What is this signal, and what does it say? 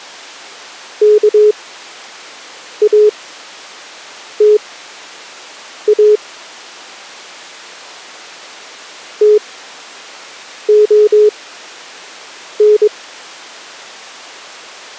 Morse code (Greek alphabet), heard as a keyed tone, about 22 wpm, spaced as for 6 wpm, 420 Hz. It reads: ΚΑΤΑ ΤΟΝ